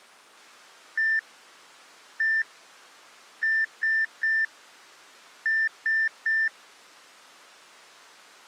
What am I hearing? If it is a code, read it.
Beep code, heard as beeps, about 1800 Hz. 1-1-3-3.